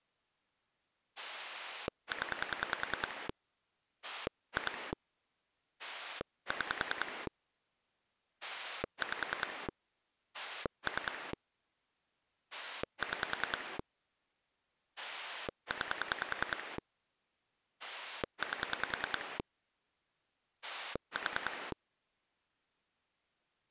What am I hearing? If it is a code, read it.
Pulse dialling, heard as a rotary dial, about 10 pulses a second. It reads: 0 2 6 5 3 6 9 8 4